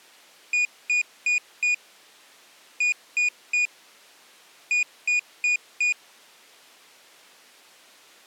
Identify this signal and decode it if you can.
Beep code, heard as a piezo beeper, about 2450 Hz. 4-3-4. In Phoenix BIOS tables: time-of-day clock failure.